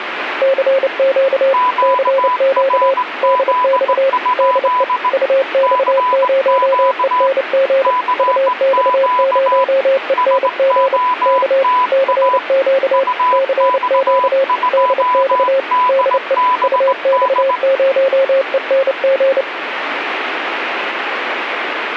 Morse code, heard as two keyed tones, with radio static. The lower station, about 29 wpm, 540 Hz: CQ CQ DX DE UX0ENG UX0ENG K CQ CQ DX DE UX0ENG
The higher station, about 18 wpm, 1000 Hz: QRZ? CQ CQ SOTA UX2DBD